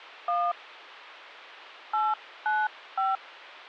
DTMF, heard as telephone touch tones, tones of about 200 ms. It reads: 1 895